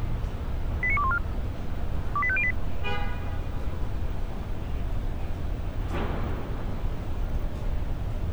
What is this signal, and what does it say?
Five-tone selective call (ZVEI), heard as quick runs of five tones, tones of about 70 ms, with street noise. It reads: 89214 28508